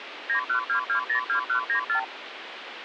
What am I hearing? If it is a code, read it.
Multi-frequency trunk signalling (R2, with the far end's replies), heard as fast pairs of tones, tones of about 100 ms, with phone line noise. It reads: 912202194